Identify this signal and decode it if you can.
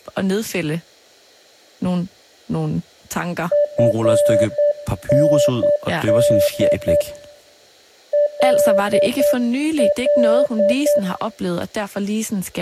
Morse code, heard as a keyed tone, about 9 wpm, 590 Hz, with room echo and speech in Danish. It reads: FND LL